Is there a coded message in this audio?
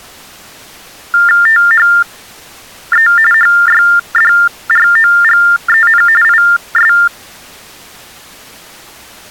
Yes: TTY/TDD text telephone tones (45.45 baud Baudot) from 1.1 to 7.1 s, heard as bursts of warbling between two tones, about 400 Hz shift, 1600 Hz centre. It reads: THE HYDROGEN IS